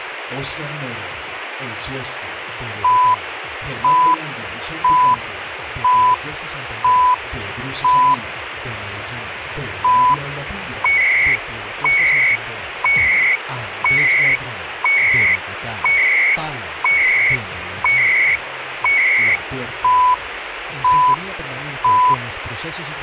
Radio time signal (CHU, Canada), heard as beeps and data bursts, one a second, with radio static.